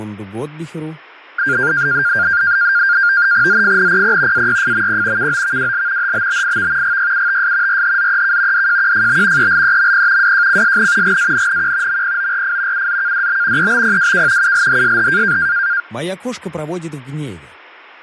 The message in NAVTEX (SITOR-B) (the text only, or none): ZFNPP AYFMP KOVWL HBBIV GYUTS RHZEK DJQFB ELEMP WJCSN GANNQ MPORF UZKDB EBPWK ULHSH